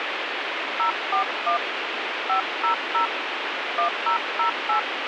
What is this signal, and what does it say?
DTMF, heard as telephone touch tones, dialled by hand, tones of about 110 ms, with radio hiss. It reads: 041 500 1008